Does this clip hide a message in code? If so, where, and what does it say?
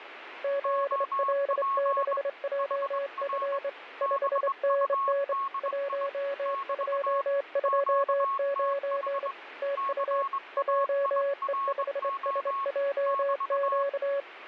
Yes: Morse code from 0.4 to 14.3 s, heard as two keyed tones, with radio static. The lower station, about 25 wpm, 560 Hz: ZL6JF 5NN 1229 TU JE5SJQ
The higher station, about 21 wpm, 1100 Hz: OP HR BUDI <BT> QTH CAIRO <BT>